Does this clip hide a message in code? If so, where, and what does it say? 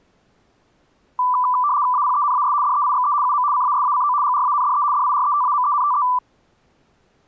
Yes: RTTY (75 baud, 170 Hz shift) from 1.2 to 6.2 s, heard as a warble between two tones, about 1080 Hz centre. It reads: APENAS DEIXE UM CASACO GRANDE DIRETAMENTE